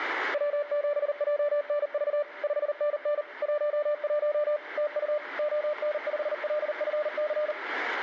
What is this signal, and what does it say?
Morse code, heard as a keyed tone, machine-sent, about 39 wpm, 590 Hz, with radio static and room echo. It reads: W7JNV 5NN 11 TU ON5LFC